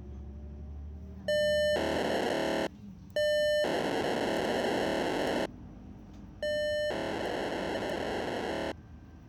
POCSAG pager data (1200 baud), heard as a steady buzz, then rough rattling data, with the noise inside a bus.